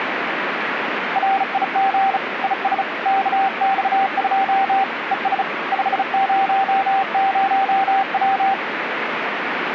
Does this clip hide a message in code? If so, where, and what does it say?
Yes: Morse code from 1.1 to 8.6 s, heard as a keyed tone, hand-sent with a bug key, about 35 wpm, 780 Hz, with radio static. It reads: RIG IS KX2 ES 500W